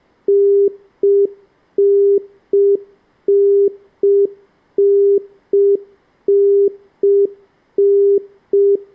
Telephone call progress tone (UK plan), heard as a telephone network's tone, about 400 Hz. Congestion tone.